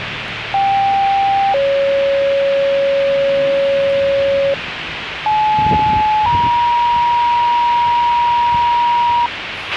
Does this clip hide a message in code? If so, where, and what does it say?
Yes: two-tone page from 0.5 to 9.3 s, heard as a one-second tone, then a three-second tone, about 790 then 550 Hz, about 860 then 950 Hz, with radio hiss, a squelch burst at the end and the noise of a residential street.